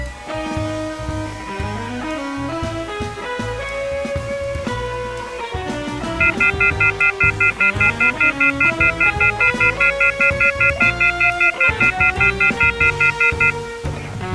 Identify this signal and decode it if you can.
Telephone call progress tone (North American plan), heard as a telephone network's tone, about 1400, 2050, 2450, 2600 Hz, 0.1 s on and 0.1 s off. Off-hook warning tone.